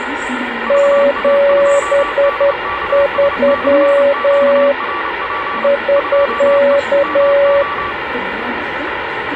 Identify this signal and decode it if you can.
Morse code, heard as two keyed tones, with radio static, room echo and the noise of a subway station. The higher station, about 29 wpm, 1150 Hz: VA2DKS/QRP 2E MO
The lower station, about 10 wpm, 560 Hz: 73 <SK>